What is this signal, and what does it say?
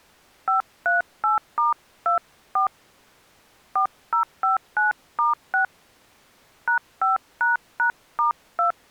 DTMF, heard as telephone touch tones, dialled by hand, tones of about 110 ms. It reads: 538*24 4059*6 #5##*2